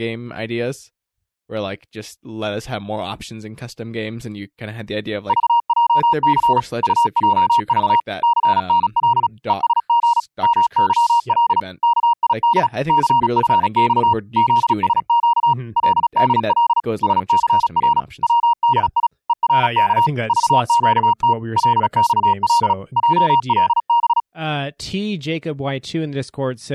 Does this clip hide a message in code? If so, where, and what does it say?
Yes: Morse code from 5.2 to 24.3 s, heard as a keyed tone, machine-sent, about 36 wpm, 940 Hz, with speech in English. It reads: VJC UJV CNL ESG MYL KID CFX ZSQ LDL SCR WDI ERK VQT LXL JLB